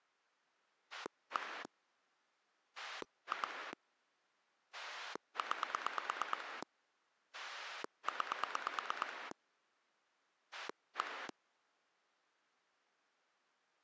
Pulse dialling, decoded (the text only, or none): 1 2 9 9 1